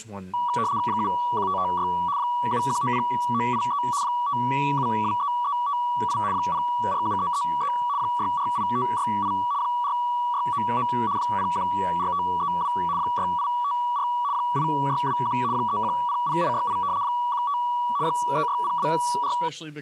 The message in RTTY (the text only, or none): 71556 7190983 5723358 047333 648568 4699 014532 6854 8621 3100868 15 36024